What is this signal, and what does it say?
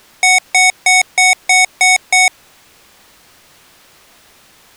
Beep code, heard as beeps from a small speaker, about 740 Hz. 7 short. In AMI BIOS tables: virtual mode exception error; in Dell tables: processor failure.